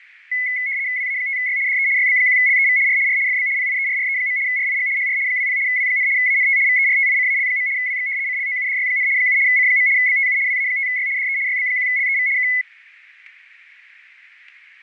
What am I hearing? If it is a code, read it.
RTTY (75 baud, 170 Hz shift), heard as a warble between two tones, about 2100 Hz centre, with static crashes. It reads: WA5Y DE YB1LEV R R FB PIERRE. RIG HR 20 W, ANT VERTICAL. WX CLOUDY, 7 C. BTU WA5Y DE YB1LEV K